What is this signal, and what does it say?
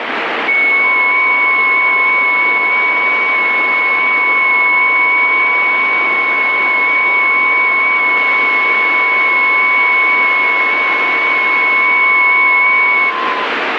FT8 (several signals at once), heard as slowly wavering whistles, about 6.25 baud, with radio static.